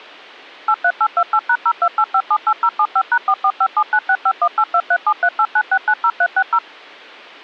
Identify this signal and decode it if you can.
DTMF, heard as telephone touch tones, dialled by machine, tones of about 60 ms. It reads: 83828#028578075#445796518237389690360